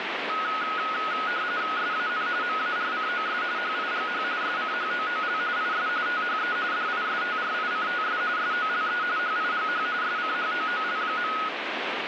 RTTY (45.45 baud, 170 Hz shift), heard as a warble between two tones, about 1360 Hz centre, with radio static. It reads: SAN MARCOS HIGH SCHOOL IS THE DISTRICTS SOLE HIGH SCHOOL.